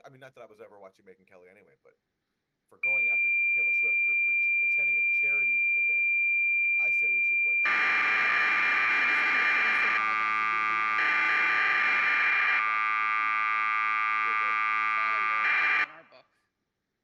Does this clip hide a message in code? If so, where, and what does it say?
Yes: cassette data (Kansas City type), 1200 baud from 2.8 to 15.8 s, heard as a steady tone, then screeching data, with speech in English.